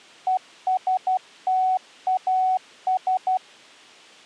Morse code, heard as a keyed tone, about 12 wpm, 750 Hz. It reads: ESTAS